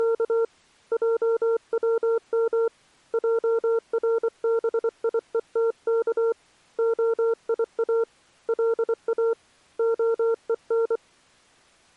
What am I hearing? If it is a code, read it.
Morse code (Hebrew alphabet), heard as a keyed tone, hand-sent with a paddle, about 24 wpm, 460 Hz. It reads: … עצם ערביותך היא לא הון